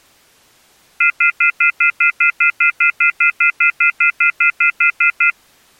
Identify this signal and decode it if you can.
Telephone call progress tone (North American plan), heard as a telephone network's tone, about 1400, 2050, 2450, 2600 Hz, 0.1 s on and 0.1 s off. Off-hook warning tone.